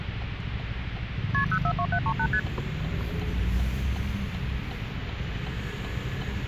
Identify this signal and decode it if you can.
Multi-frequency trunk signalling (R1, as on North American trunks), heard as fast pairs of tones, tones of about 70 ms, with phone line noise and the noise inside a car. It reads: KP 042738 ST